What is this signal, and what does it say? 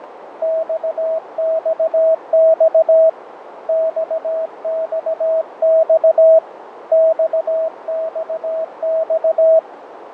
Morse code, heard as a keyed tone, hand-sent with a paddle, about 17 wpm, 650 Hz, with radio static, fading and a narrow filter. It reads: XXX XXX XXX